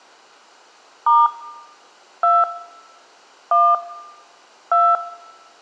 DTMF, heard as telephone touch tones, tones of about 210 ms, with room echo. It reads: * 2 1 2